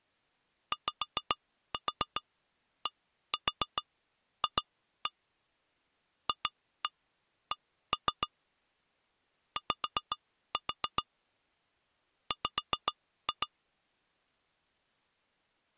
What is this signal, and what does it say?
Tap code, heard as taps on glass, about 7 knocks a second. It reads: YDF FC Y W